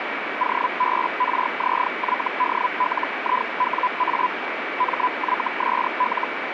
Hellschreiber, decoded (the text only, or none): OBRZYDLIWA MYSL